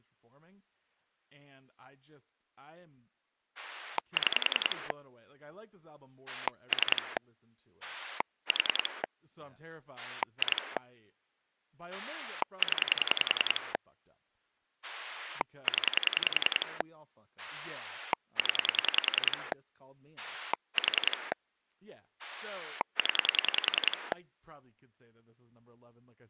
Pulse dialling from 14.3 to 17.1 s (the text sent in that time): 0